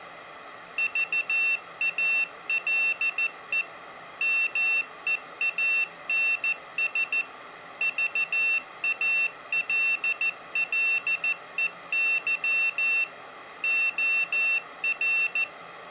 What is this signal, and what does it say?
Morse code, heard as a high beeper, machine-sent, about 14 wpm, 2700 Hz. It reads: VALE MEANS VALLEY OR